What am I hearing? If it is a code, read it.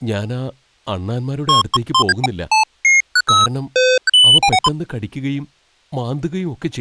Electronic bleeps of random pitch and length, with speech in Malayalam. There is no code.